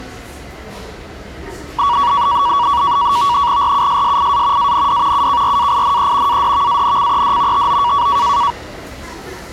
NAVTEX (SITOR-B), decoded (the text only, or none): RUSSIA AND UKRAINE ADVANCED TO